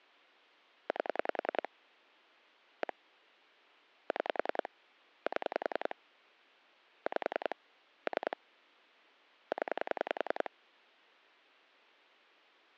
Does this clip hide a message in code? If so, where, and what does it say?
Yes: pulse dialling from 0.9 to 10.5 s, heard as clicks on a phone line, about 10 pulses a second. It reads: 8 1 6 7 5 3 0